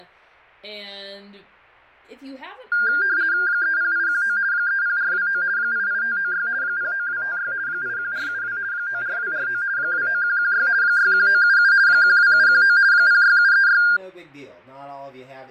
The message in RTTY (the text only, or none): 30819 30429 88596 09256 81472 94249 29116 61977 12719 06736